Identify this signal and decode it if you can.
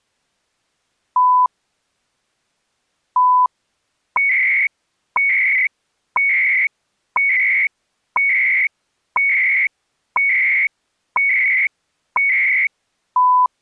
Radio time signal (CHU, Canada), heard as beeps and data bursts, one a second.